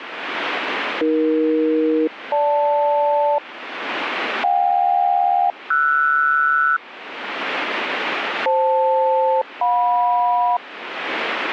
Aircraft SELCAL, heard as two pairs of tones, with radio static. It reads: AE-GL JK-RS FL-JM